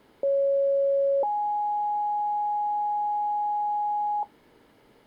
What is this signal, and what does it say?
Two-tone page, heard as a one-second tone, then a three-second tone, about 550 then 830 Hz.